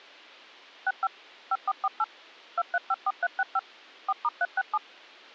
DTMF, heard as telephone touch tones, dialled by machine, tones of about 40 ms. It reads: 65 5448 2354365 4*367